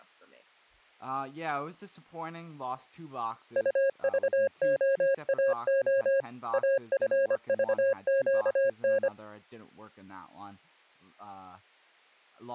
Morse code, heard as a keyed tone, machine-sent, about 25 wpm, 540 Hz, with speech in English. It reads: UVOAO AFVQN